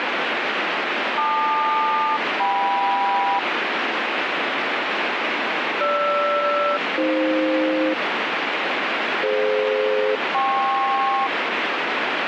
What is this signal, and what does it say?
Aircraft SELCAL, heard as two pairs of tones, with radio static. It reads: LQ-KM GR-AF DF-KP